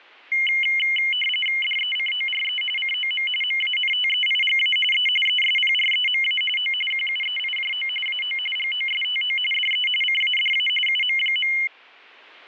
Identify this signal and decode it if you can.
RTTY (45.45 baud, 850 Hz shift), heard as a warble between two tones, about 2550 Hz centre, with static crashes. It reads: DECORE COM MANTEIGA E ESPREMA O QUEIJO AO GOSTO DE CADA UM.